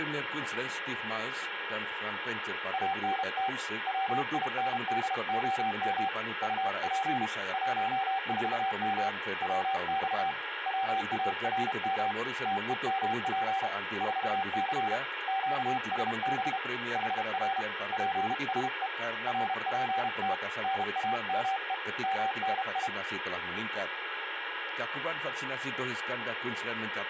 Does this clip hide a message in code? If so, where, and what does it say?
Yes: Morse code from 2.7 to 22.9 s, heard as a keyed tone, hand-sent with a paddle, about 32 wpm, 780 Hz, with radio static and a steady whistle near 1650 Hz. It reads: ANT WINDOM UP 14M WX WARM TEMP 4C QSB HR PSE RPT NAME MNI